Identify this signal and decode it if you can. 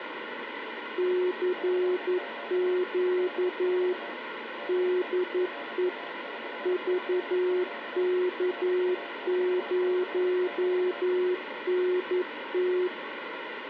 Morse code, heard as two keyed tones, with radio static. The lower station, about 11 wpm, 360 Hz: CQ DE VK0NT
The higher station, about 27 wpm, 700 Hz: CQ DX DE RA4CQ RA4CQ